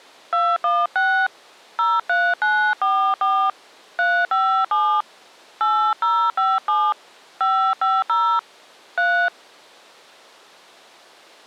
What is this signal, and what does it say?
DTMF, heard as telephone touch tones, dialled by hand, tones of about 270 ms. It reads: 216 03944 357 8057 550 3